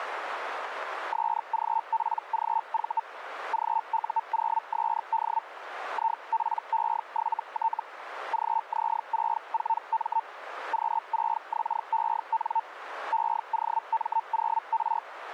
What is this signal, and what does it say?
Hellschreiber (Feld-Hell, 122.5 baud), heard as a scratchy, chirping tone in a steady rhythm, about 900 Hz, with radio static. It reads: SGPGV GU0SD IPE7T GZ64M Q6XEN EOM0R